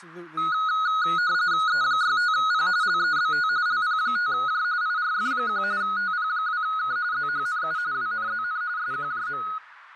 RTTY (45.45 baud, 170 Hz shift), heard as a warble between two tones, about 1360 Hz centre, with radio static, fading, a narrow filter and speech in English. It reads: E65P LEBT LP5J IRF1 TP2K ZHNU WNZN SQJM